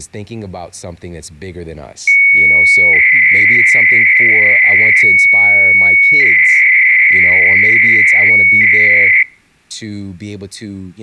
300-baud modem data (Bell 103 tones), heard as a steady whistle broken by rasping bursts, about 300 baud, 200 Hz shift, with speech in English.